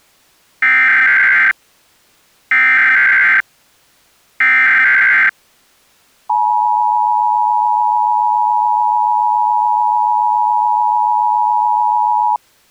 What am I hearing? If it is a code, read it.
Emergency Alert System (SAME) tones (header bursts, then the 853 and 960 Hz attention tone), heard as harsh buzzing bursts, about 520.83 baud.